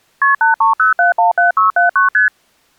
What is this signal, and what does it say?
Multi-frequency trunk signalling (R1, as on North American trunks), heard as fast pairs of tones, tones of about 130 ms. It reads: KP 830717679 ST